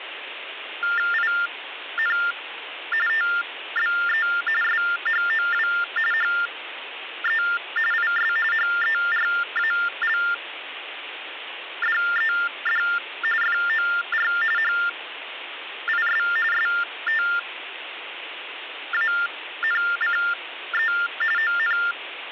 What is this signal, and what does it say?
TTY/TDD text telephone tones (45.45 baud Baudot), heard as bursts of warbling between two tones, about 400 Hz shift, 1600 Hz centre, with phone line noise. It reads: IN TBE SHOW HE IS HERALDED FOR HIS STANCE ON